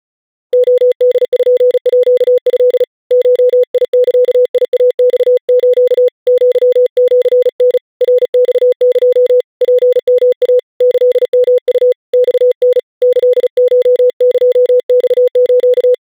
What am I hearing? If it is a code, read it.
Morse code (Japanese Wabun code), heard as a keyed tone, hand-sent with a paddle, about 36 wpm, 500 Hz. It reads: レポート ゴザイマス アシタ ナマエ ツヨイ キヨウ マタ キコエマス